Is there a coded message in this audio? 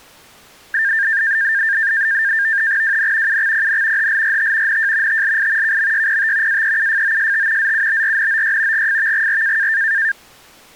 Yes: NAVTEX (SITOR-B), 100 baud, 170 Hz shift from 0.7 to 10.1 s, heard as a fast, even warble, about 1700 Hz centre. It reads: WN UXPN HLRT NJ TLI KMYPT AEUFOST ZUBRNOY GFVGR